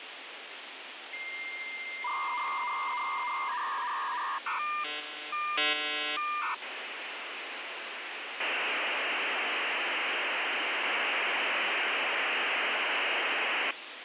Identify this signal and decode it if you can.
Dial-up modem handshake (V.34 or later), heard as a whistle, warbles, then hiss, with phone line noise.